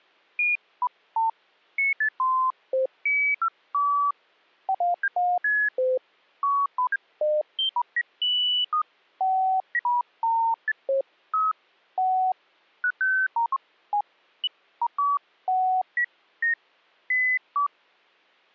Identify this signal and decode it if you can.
Electronic bleeps of random pitch and length. There is no code.